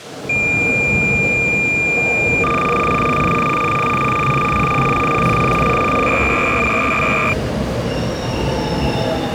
Cassette data (Kansas City type), 300 baud, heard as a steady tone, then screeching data, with the noise of a subway station.